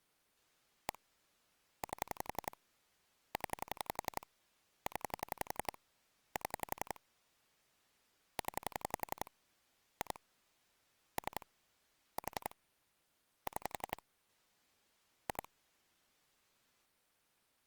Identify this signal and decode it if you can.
Pulse dialling, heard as clicks on a phone line, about 11 pulses a second. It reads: 1 8 0 0 7 0 2 3 4 6 2